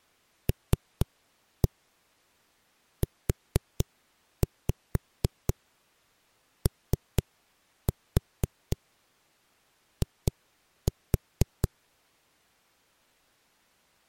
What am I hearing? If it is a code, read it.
Tap code, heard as knocks on a wall, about 4 knocks a second. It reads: LUOI